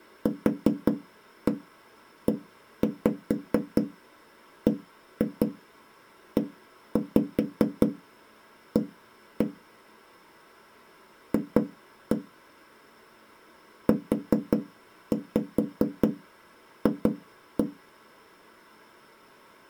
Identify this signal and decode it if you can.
Tap code, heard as knocks on wood, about 5 knocks a second. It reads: QEBEA F UF